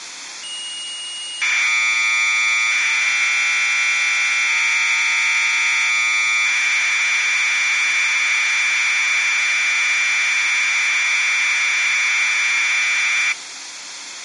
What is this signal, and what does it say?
Commodore tape loading (standard loader), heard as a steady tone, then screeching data, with tape hiss.